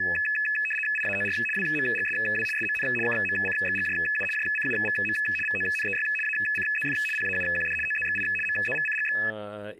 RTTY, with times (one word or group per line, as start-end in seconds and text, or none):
1.0-1.4 IAOR
1.6-2.5 WMGSW
2.6-2.9 SMN
3.1-4.2 KMCXGJU
4.4-5.2 JCUVM
5.5-6.1 VONEY
6.2-7.0 ACZF
7.2-7.8 PAUQD
7.9-8.2 OZXI
8.5-9.2 MZVCGX